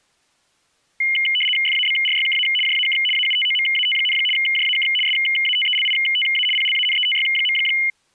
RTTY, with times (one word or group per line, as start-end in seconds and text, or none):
1.7-2.5 FABRYKA
2.7-3.0 JAK
3.2-4.2 AUTOMAT,
4.4-4.9 JAK
5.1-6.5 SATELITA
6.6-7.6 PLANETY.